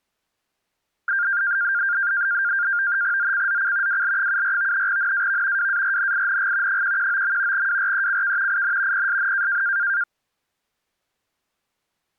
NAVTEX (SITOR-B), 100 baud, 170 Hz shift, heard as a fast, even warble, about 1500 Hz centre. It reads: ZCZC WL74 NAV WARNING 119. WRECK IN PSN